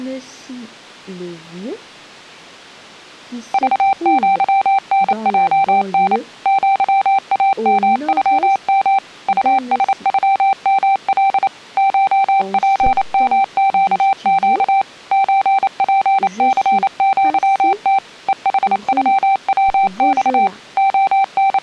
Morse code (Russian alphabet), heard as a keyed tone, machine-sent, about 28 wpm, 780 Hz. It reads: ЖЪНЙН ЪАМЮМ УСЮМЛ ШПМЩЩ ЧПЦЪТ ЕХЮВЬ …